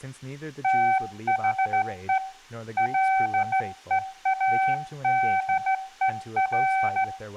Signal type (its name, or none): Morse code